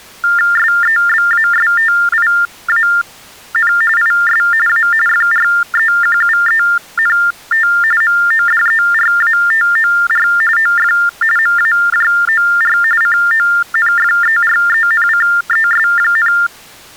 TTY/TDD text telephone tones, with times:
0.6-3.7 SEBASTIAN
4.0-4.4 IS
4.7-4.9 A
5.1-7.7 FREQUENT
8.0-10.3 MODERATOR
10.6-10.9 OF
11.4-12.8 MAJOR
13.0-16.3 CONFERENCES,

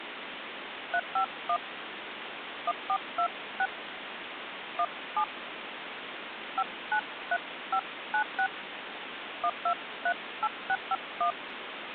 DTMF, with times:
0.9-1.6 351
2.7-3.7 1426
4.8-5.2 17
6.6-8.5 593596
9.4-11.3 1238651

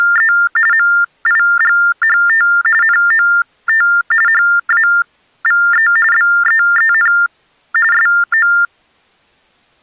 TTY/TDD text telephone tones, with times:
0.0-0.3 …
0.7-2.5 MIGHT
2.8-3.9 NOT
4.3-5.9 HAVE
6.1-7.1 BEEN
7.9-8.5 SO

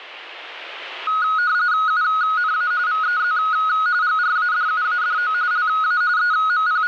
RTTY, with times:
1.9-2.7 UNA
2.9-3.4 VEZ
4.0-5.3 GRADUADO
5.5-6.0 LA
6.2-6.9 …

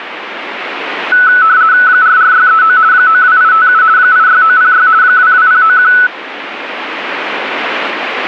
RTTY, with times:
1.9-2.8 44639
2.9-3.8 92857
4.0-4.9 86906
5.0-5.9 22091

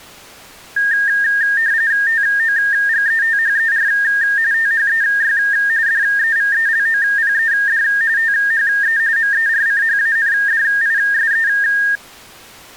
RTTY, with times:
2.1-3.9 TOGETHER
4.5-5.4 THEY
5.9-7.8 DEVELOPED
8.2-9.0 THE
9.2-11.5 MERCHANDISE

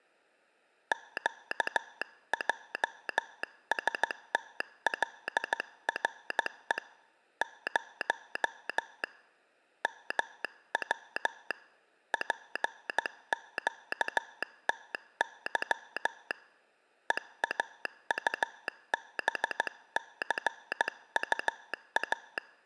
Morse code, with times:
0.9-6.8 QJSTLRE
7.4-9.0 0
9.8-11.5 MW
12.1-16.3 PQTY
17.1-22.4 EAUBCUA

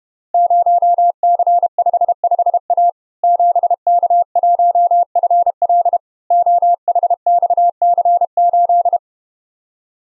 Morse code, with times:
0.3-2.9 0C55A
3.2-6.0 7K1FL
6.3-9.0 OHXC8

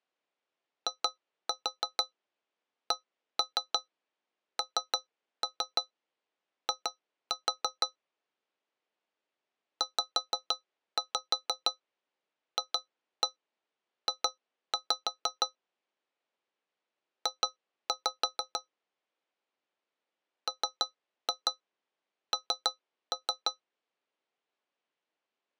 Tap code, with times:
0.9-7.9 ICNI
9.8-15.5 ZFJ
17.3-18.6 J
20.5-23.5 MN

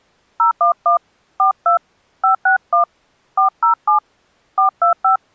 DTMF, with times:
0.4-1.0 011
1.4-1.8 42
2.2-2.8 561
3.4-4.0 407
4.6-5.2 425

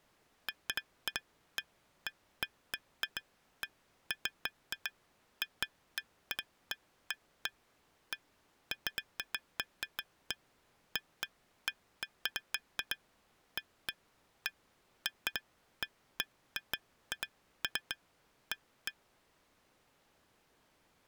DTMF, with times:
none

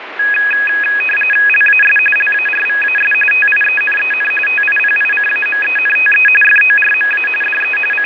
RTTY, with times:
1.5-2.0 LAS
2.2-3.1 LARVAS
3.3-4.3 TIENEN
4.5-6.3 TIPICAMENTE
6.4-7.3 FORMA
7.4-7.8 DE
7.9-8.1 …

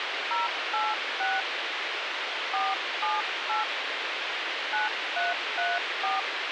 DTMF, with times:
0.3-1.4 086
2.5-3.6 478
4.7-6.2 9334

